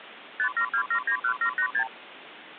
Multi-frequency trunk signalling (R2, with the far end's replies), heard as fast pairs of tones, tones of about 80 ms, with phone line noise. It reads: 572791786